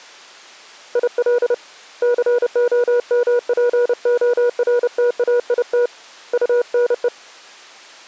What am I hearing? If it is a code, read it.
Morse code, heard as a keyed tone, hand-sent with a paddle, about 30 wpm, 480 Hz. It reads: IL COMPORTAIT UNE